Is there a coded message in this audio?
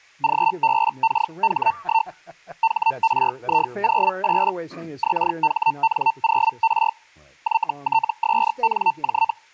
Yes: Hellschreiber (Feld-Hell, 122.5 baud) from 0.2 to 9.3 s, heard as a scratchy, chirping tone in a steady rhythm, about 900 Hz, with speech in English. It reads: GBKH1 HRI08 XHN0R YTSNJ